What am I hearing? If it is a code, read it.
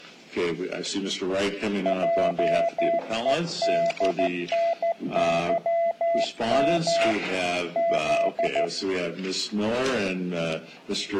Morse code, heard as a keyed tone, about 14 wpm, 670 Hz. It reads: JEDNYM Z